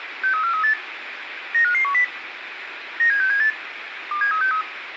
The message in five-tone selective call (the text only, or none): 63438 95510 97678 27363